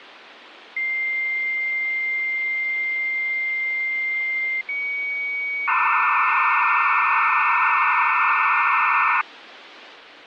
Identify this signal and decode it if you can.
Dial-up modem handshake (low-speed, two carriers), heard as two whistles, then hiss, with phone line noise.